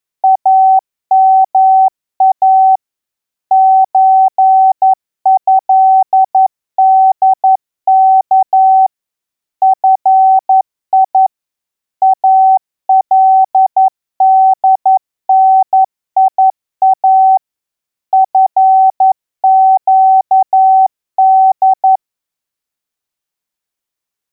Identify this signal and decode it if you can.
Morse code (Arabic alphabet), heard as a keyed tone, machine-sent, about 11 wpm, 760 Hz. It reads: اما زهدك في الدنيا فقد